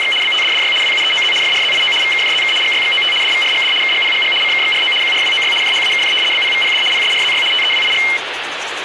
RTTY (75 baud, 850 Hz shift), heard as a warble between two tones, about 2550 Hz centre, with radio static and the noise of a restroom. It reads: … BTDDY WUEOZ FRZIO VKJZK GYXOT DVRGD KGPGG CKXRO QRWOY JHAKJ BPVPD PSRZY TEWIG